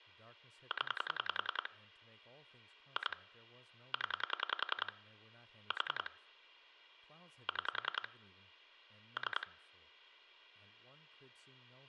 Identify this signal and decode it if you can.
Pulse dialling, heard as clicks on a phone line, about 10 pulses a second, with speech in English. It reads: 0 2 0 4 6 3